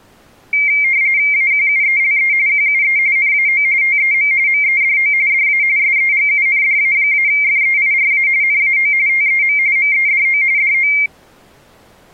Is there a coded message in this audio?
Yes: RTTY (45.45 baud, 170 Hz shift) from 0.5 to 11.1 s, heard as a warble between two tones, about 2200 Hz centre. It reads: AQUELE QUE NAO TEM MEDO DA SEGUNDA-FEIRA NAO TEM MEDO DO